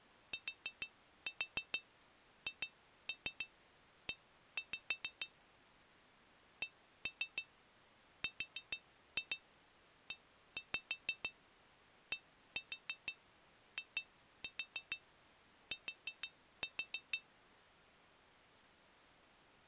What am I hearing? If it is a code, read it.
Tap code, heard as taps on glass, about 6 knocks a second. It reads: THE CREDIT